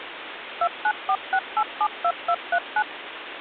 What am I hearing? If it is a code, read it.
DTMF, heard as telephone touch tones, dialled by machine, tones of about 60 ms, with phone line noise. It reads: 2946872239